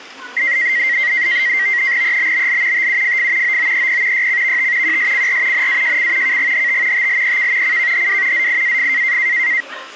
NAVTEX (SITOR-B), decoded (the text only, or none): EBBL TUFF OOEP YCVT QSCR NAJC KGHT TLEK CKHW ZIAF